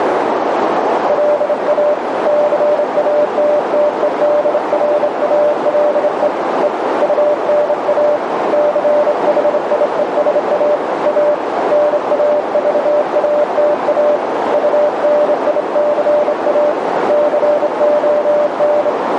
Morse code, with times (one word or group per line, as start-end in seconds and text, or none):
1.1-1.9 LA
2.3-6.3 CATTEDRALE
6.6-6.7 E
7.0-8.2 UNA
8.5-10.8 CHIESA
11.1-11.3 A
11.7-14.2 NAVATA
14.5-16.7 UNICA
17.1-18.9 CON